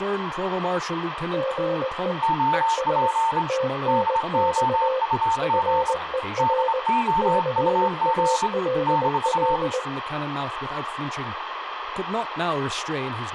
Morse code, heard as two keyed tones, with radio static, room echo and speech in English. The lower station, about 20 wpm, 520 Hz: GE ES TNX FER CALL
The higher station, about 25 wpm, 900 Hz: OP DOUG DOUG -